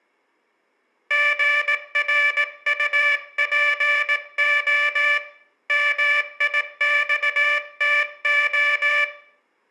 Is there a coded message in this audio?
Yes: Morse code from 1.0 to 9.1 s, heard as a buzzer, hand-sent with a paddle, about 18 wpm, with room echo. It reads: GRUPO MIXTO